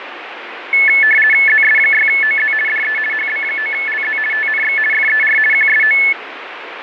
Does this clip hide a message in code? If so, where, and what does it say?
Yes: RTTY (50 baud, 450 Hz shift) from 0.7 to 6.1 s, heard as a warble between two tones, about 1950 Hz centre, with radio static and fading. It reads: ZS6OZ DE HB9LZ TNX FER QSO